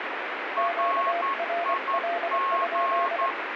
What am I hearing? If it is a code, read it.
Morse code, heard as two keyed tones, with radio static. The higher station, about 11 wpm, 1090 Hz: RIG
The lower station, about 24 wpm, 690 Hz: QRL?